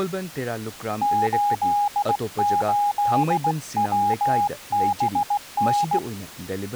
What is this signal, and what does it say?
Morse code, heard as a keyed tone, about 17 wpm, 820 Hz, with speech in Manipuri. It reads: 88WBN